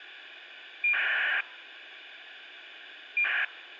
ACARS aircraft data, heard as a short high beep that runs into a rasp, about 2400 baud, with radio hiss.